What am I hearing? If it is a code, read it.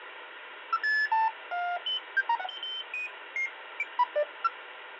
Electronic bleeps of random pitch and length, with phone line noise. There is no code.